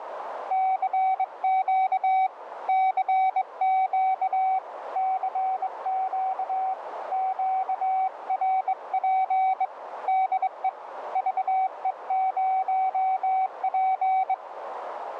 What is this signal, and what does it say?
Morse code, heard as a keyed tone, hand-sent with a straight key, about 22 wpm, 760 Hz, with radio static and a narrow filter. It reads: CQ CQ CQ QRP DE VE0P